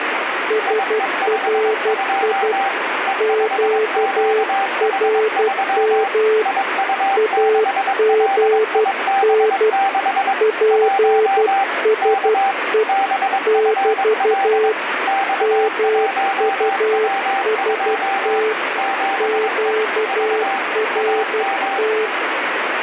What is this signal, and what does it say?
Morse code, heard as two keyed tones, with radio static. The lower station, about 12 wpm, 440 Hz: SRI QRM AGN PSE <BT> MUST QRT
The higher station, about 22 wpm, 780 Hz: IE52 E5QH3 IU6LIB6 1 K BFL X1W2 7E V AM